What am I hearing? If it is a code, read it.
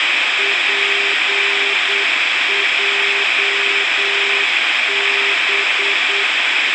Morse code, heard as a keyed tone, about 8 wpm, 400 Hz, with radio hiss. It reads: PJB